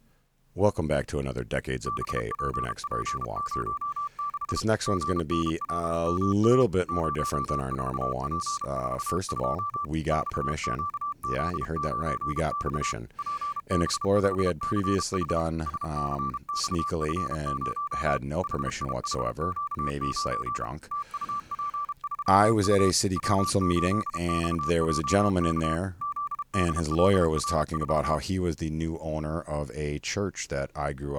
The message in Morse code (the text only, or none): BPP06 GNLMA 04P42 XQZ9X PB5CH SCXF0 HIHQ9 TUP3U W8XJK ZDLR4